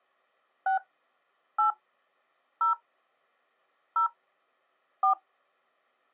DTMF, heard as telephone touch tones, dialled by hand, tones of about 110 ms. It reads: 6 8 0 0 4